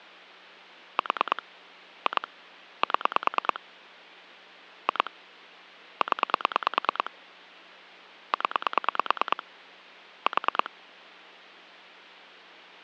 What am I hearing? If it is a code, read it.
Pulse dialling, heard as clicks on a phone line, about 9 pulses a second. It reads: 4 2 7 2 0 0 4